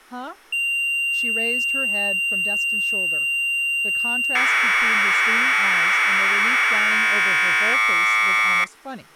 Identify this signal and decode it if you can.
Commodore tape loading (standard loader), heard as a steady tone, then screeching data, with speech in English.